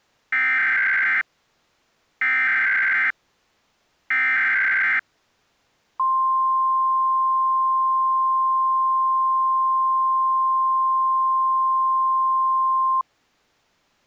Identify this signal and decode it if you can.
Emergency Alert System (SAME) tones (header bursts, then the 1050 Hz attention tone), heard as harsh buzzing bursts, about 520.83 baud.